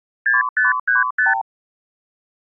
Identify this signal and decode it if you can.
Multi-frequency trunk signalling (R2, with the far end's replies), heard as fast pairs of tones, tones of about 150 ms. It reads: 6535